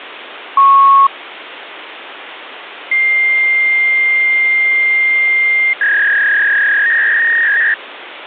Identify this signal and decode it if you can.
Fax machine handshake, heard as a beep, a long tone and a warble, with phone line noise.